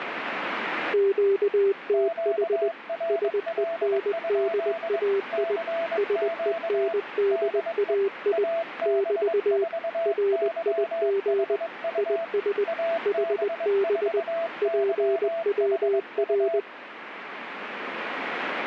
Morse code, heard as two keyed tones, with radio static. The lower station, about 20 wpm, 390 Hz: QTH SENDAI SENDAI <BT> RIG IS HB PWR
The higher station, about 22 wpm, 670 Hz: QRL? CQ DE AB4YHU AB4YHU